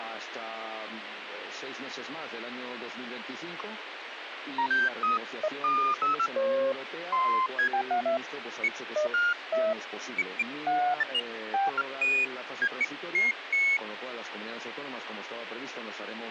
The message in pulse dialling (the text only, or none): none